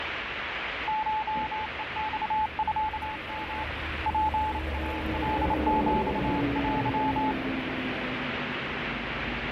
Morse code (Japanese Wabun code), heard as a keyed tone, hand-sent with a bug key, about 28 wpm, 860 Hz, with radio static and street noise. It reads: コヘマミヨ ツイカヒテ